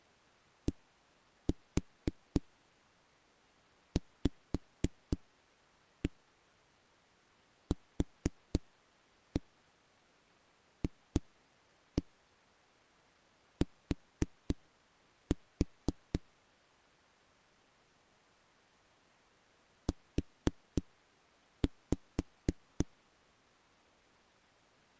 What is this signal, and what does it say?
Tap code, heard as knocks on a wall, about 3 knocks a second. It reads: DVQFT U